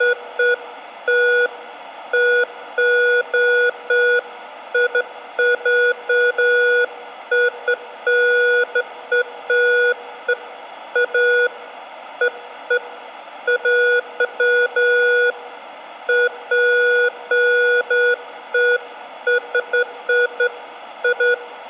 Beeps of irregular length, with room echo. There is no code.